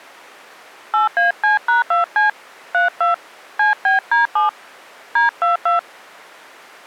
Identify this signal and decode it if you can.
DTMF, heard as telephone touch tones, dialled by hand, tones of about 140 ms. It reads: 8AC#2C 32 CBD7 D22